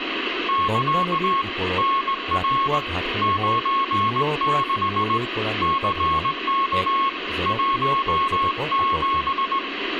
Morse code, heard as a keyed tone, hand-sent with a straight key, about 19 wpm, 1090 Hz, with radio static, room echo and speech in Assamese. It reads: <KA> NR 96 CK 17